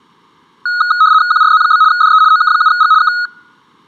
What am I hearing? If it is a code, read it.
RTTY (75 baud, 170 Hz shift), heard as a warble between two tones, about 1360 Hz centre. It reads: QRZ? DE OK7G K